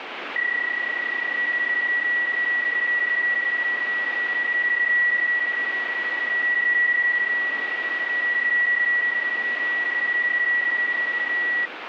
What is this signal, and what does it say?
PSK31 (31.25 baud), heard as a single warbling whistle, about 1950 Hz, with radio static.